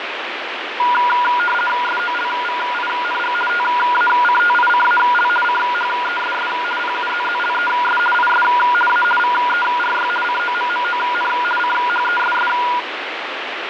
RTTY (50 baud, 450 Hz shift), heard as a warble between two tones, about 1200 Hz centre, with radio static and fading. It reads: SOLVING TACTICAL CHESS PUZZLES IS A VERY COMMON CHESS